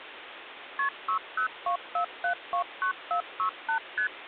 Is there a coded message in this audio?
Yes: multi-frequency trunk signalling (R1, as on North American trunks) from 0.8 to 4.1 s, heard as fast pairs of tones, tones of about 100 ms, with phone line noise. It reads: KP 6024729468 ST